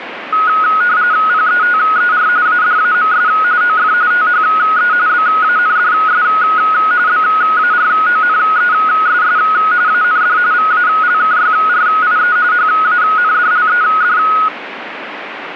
RTTY (45.45 baud, 170 Hz shift), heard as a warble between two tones, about 1360 Hz centre, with radio static. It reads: PETER ADAMS OF THE BANDS BARONESS AND VALKYRIE HANDLED